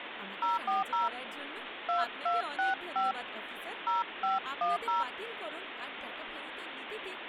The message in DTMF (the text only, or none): 040 2265 0510